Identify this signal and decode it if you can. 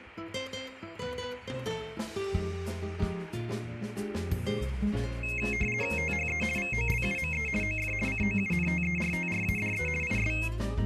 RTTY (50 baud, 450 Hz shift), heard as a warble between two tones, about 2350 Hz centre. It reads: THE VOLUME OF COUNTERTRADE IS